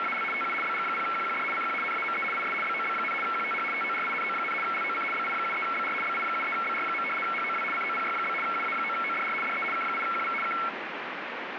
RTTY (75 baud, 850 Hz shift), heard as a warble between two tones, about 1800 Hz centre, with radio static. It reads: … TU BG0QQD CQ NAME IS BOB, QTH TORINO, LOC BI73BR BI73BR. HOW COPY? UA9ODR DE K8QV K